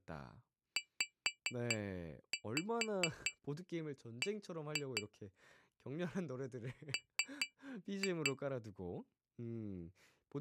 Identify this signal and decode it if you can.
Tap code, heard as taps on glass, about 4 knocks a second, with speech in Korean. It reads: ZB M